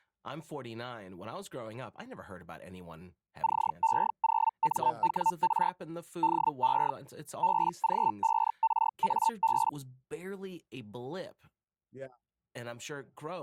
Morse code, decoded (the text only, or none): none